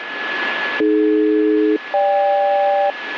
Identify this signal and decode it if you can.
Aircraft SELCAL, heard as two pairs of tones, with radio static and a steady whistle near 1710 Hz. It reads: AD-GK